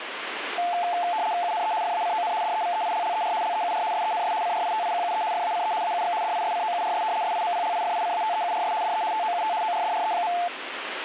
RTTY (75 baud, 170 Hz shift), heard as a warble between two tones, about 790 Hz centre, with radio static. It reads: UNE FACON DEVEILLER LEUR SENS CRITIQUE FACE AUX DISCOURS SIMPLIFICATEURS DE TOUT ORDRE.